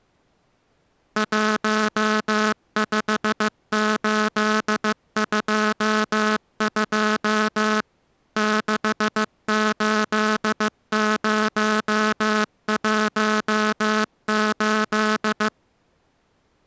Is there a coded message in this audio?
Yes: Morse code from 1.1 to 15.5 s, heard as a buzzer, machine-sent, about 15 wpm. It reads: 15822 68018